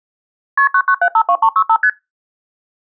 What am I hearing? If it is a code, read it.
Multi-frequency trunk signalling (R1, as on North American trunks), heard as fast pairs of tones, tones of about 70 ms. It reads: KP 99752365 ST